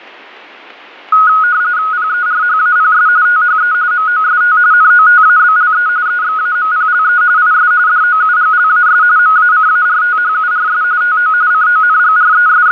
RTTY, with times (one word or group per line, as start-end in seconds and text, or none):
1.9-3.1 PERHAPS
3.3-3.7 THE
3.9-4.6 MOST
4.7-5.9 NOTABLE
6.1-7.2 EXAMPLE
7.4-7.7 IS
7.9-9.0 DOUGLAS
9.2-10.8 MACARTHURS
11.0-11.3 TO
11.5-12.7 …